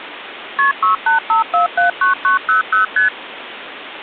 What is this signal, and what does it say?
Multi-frequency trunk signalling (R1, as on North American trunks), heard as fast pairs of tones, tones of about 130 ms, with phone line noise. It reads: KP 685479900 ST